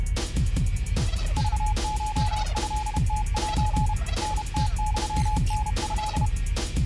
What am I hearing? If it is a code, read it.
Morse code (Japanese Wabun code), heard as a keyed tone, hand-sent with a paddle, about 31 wpm, 850 Hz. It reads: クコトムセ タムユタト